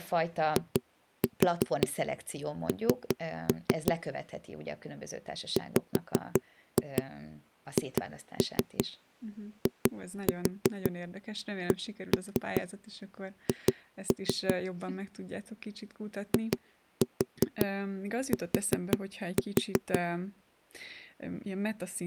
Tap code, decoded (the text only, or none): IN WHICH IT